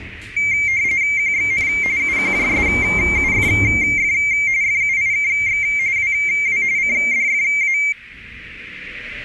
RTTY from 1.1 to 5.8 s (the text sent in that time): QXN UQJSUFF FUIKX